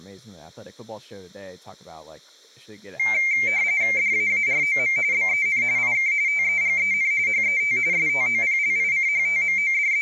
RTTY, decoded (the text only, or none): DAAROM BEN IK TEGEN HET …